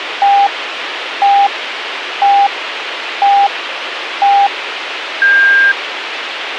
Radio time signal (five pips and a higher one, as on Chinese radio), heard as pips, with radio hiss.